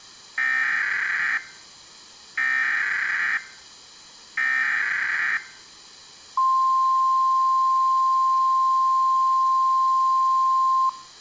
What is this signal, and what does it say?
Emergency Alert System (SAME) tones (header bursts, then the 1050 Hz attention tone), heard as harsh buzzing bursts, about 520.83 baud.